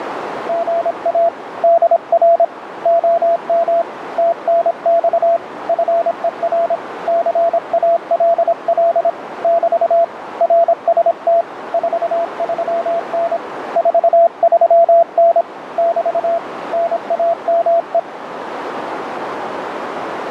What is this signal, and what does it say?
Morse code, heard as a keyed tone, hand-sent with a paddle, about 26 wpm, 680 Hz, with radio static and a narrow filter. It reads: GA DR OM TNX FER CALL <BT> RST 43N 43N <BT> NAME